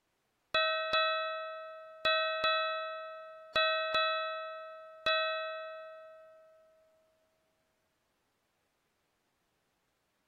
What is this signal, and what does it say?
Ship's bell, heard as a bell. 7. Seven half-hours of the watch have passed.